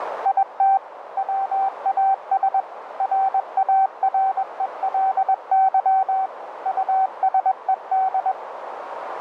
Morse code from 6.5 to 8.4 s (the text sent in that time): USED